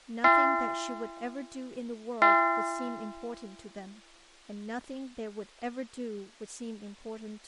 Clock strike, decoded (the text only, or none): 2